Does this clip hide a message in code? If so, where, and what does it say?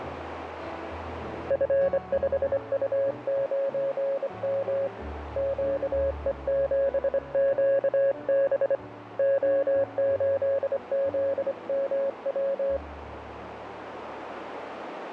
Yes: Morse code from 1.4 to 12.8 s, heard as a keyed tone, hand-sent with a straight key, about 25 wpm, 550 Hz, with radio static and a narrow filter. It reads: F5U9M QE7QB O8ZMW